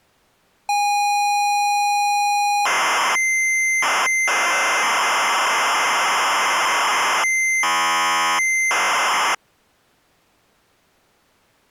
ZX Spectrum tape loading, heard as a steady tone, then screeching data.